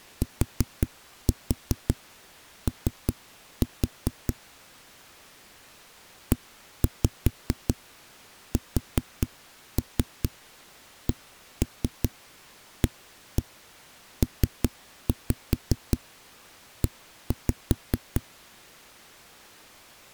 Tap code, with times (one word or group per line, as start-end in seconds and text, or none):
0.2-4.3 TO
6.3-18.2 ESCAPE